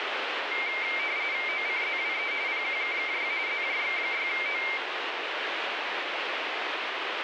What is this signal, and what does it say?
RTTY (45.45 baud, 170 Hz shift), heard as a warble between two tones, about 2200 Hz centre, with radio static. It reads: OCZWE PQKKY ZJX6O